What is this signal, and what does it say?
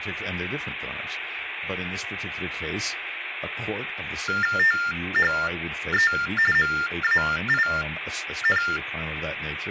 TTY/TDD text telephone tones (45.45 baud Baudot), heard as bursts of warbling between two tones, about 400 Hz shift, 1600 Hz centre, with phone line noise and speech in English. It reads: THE MAIN